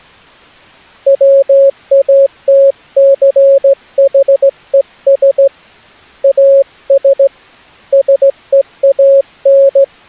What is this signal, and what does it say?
Morse code, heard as a keyed tone, hand-sent with a straight key, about 16 wpm, 550 Hz. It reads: WATCHES AS SEAN